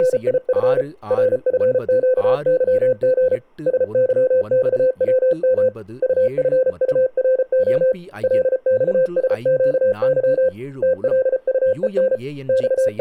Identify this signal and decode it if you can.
Morse code, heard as a keyed tone, hand-sent with a paddle, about 34 wpm, 520 Hz, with speech in Tamil. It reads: … RFQYG SYXWM UFURO LXSQY TLUEN …